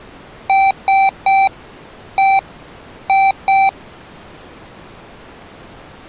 Beep code, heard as beeps from a small speaker, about 780 Hz. 3-1-2. In Phoenix BIOS tables: DMA register failure.